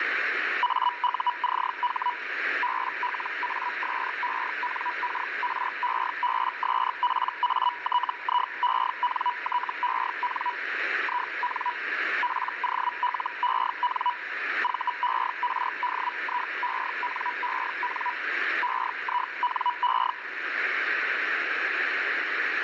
Hellschreiber (Feld-Hell, 122.5 baud), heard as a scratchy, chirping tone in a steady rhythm, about 980 Hz, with radio static. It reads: AUCH BLASENKREBSPATIENTEN IN POLEN VERDIENEN EINE